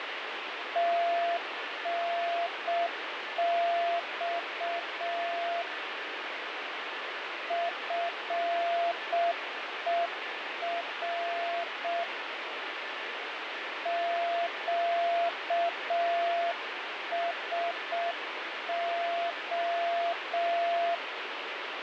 Morse code, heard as a keyed tone, hand-sent with a paddle, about 6 wpm, 680 Hz, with radio static and a weaker station near 1750 Hz. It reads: TNX FER QSO